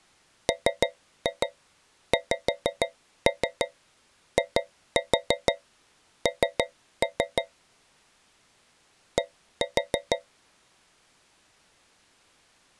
Tap code, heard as taps on a metal pipe, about 6 knocks a second. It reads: MXIN D